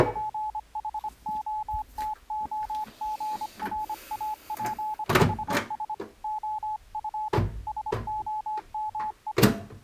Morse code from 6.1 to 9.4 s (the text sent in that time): OF SOME